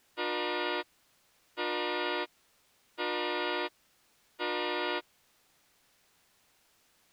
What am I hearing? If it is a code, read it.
Train horn signal, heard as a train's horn. 4 short. On North American railways: a request for a signal to be given or repeated.